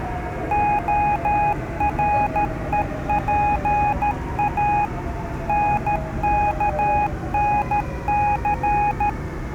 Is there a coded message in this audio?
Yes: Morse code (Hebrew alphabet) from 0.5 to 9.2 s, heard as a keyed tone, machine-sent, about 13 wpm, 830 Hz, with the noise inside a subway train. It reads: הרופא נכנס